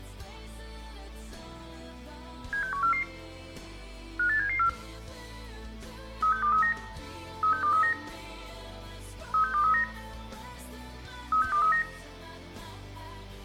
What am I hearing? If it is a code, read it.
Five-tone selective call (CCIR), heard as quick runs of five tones, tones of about 100 ms, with room echo. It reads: 76144 58774 36239 36239 36239 36239